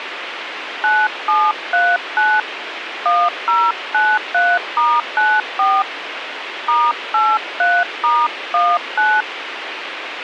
DTMF, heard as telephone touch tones, dialled by hand, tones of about 230 ms, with radio hiss. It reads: 9739 1093*94 *83*19